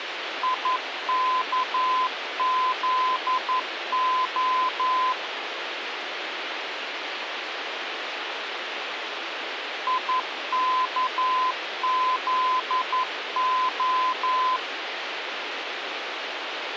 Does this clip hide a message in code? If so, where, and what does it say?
Yes: Morse code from 0.4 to 14.6 s, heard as a keyed tone, machine-sent, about 11 wpm, 1020 Hz, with radio hiss. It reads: IKZO IKZO